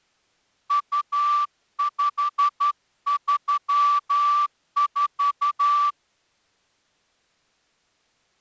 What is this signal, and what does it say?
Morse code (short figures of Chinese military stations), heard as a whistle, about 12 wpm. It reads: 2534